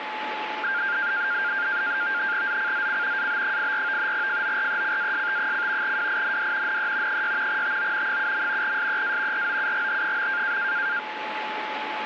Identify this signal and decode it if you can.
NAVTEX (SITOR-B), 100 baud, 170 Hz shift, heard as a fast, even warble, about 1500 Hz centre, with radio static and a steady whistle near 860 Hz. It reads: ZCZC AB84 FORECAST: WIND NE 6 TO 7. SEA ROUGH.